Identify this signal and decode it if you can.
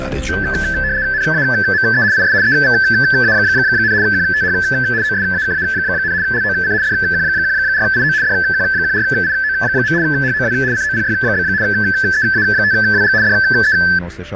RTTY (75 baud, 170 Hz shift), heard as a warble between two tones, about 1650 Hz centre, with radio static and fading. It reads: NAME IS EVA, QTH OSAKA, LOC DQ14IO DQ14IO. HOW COPY? EA5WG DE